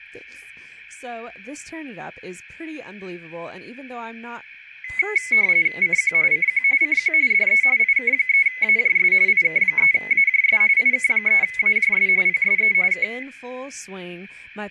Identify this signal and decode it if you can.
RTTY (45.45 baud, 170 Hz shift), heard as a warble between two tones, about 2100 Hz centre, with room echo and speech in English. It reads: CQ CQ CQ DE IK3AJS IK3AJS IK3AJS PSE K